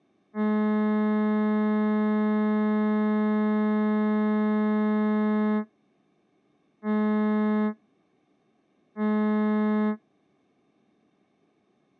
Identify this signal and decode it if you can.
Ship horn signal, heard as a ship's horn, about 210 Hz. 1 long, 2 short. At sea: a vessel in fog that is sailing, fishing, towing or hampered.